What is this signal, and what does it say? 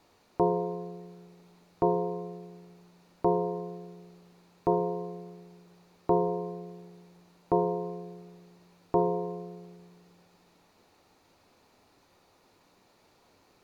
Clock strike, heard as a bell. 7. Seven o'clock.